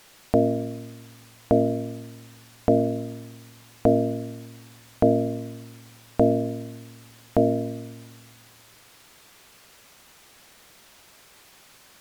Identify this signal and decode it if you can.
Clock strike, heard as a bell. 7. Seven o'clock.